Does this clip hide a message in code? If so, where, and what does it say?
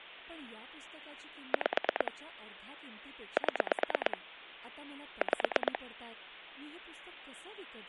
Yes: pulse dialling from 1.5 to 5.8 s, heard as clicks on a phone line, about 9 pulses a second, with speech in Marathi. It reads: 5 7 5